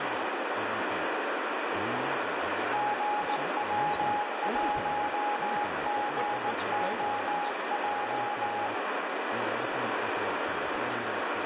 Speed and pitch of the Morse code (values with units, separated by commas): 19 wpm, 830 Hz